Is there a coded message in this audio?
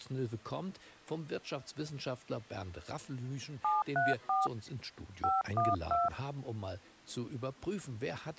Yes: DTMF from 3.6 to 6.1 s, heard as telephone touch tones, dialled by hand, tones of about 180 ms. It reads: 734 512